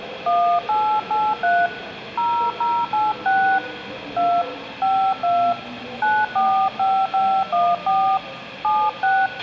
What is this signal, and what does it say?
DTMF, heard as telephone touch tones, dialled by hand, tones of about 260 ms, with a squelch burst at the end and the noise of a subway station. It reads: 1883 0086 2 52 945514 76